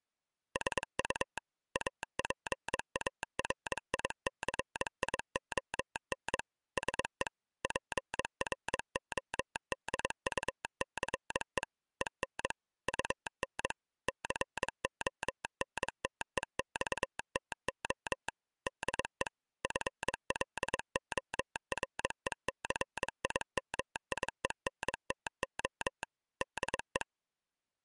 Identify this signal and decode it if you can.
Morse code, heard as a telegraph sounder, machine-sent, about 22 wpm. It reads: SU APARICION SE PRODUCE EN UN CONTEXTO DE FLORECIMIENTO DE